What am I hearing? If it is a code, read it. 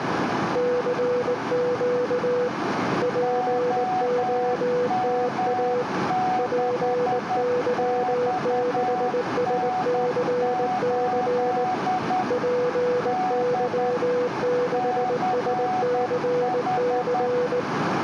Morse code, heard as two keyed tones, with radio static and a narrow filter. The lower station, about 19 wpm, 490 Hz: CQ POTA PY6SCC PY6SCC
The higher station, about 10 wpm, 740 Hz: OM6XN8 D CH